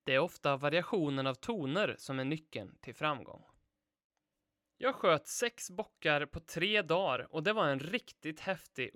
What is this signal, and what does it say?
Speech in Swedish. There is no code.